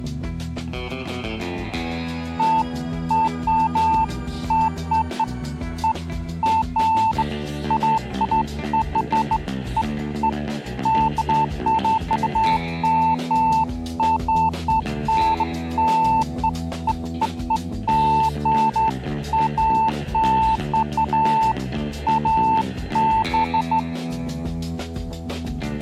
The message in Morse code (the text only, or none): none